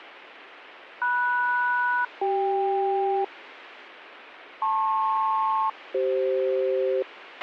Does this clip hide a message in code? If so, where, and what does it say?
Yes: aircraft SELCAL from 1.0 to 7.0 s, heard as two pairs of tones, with radio hiss and a squelch burst at the end. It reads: MS-CK LP-CF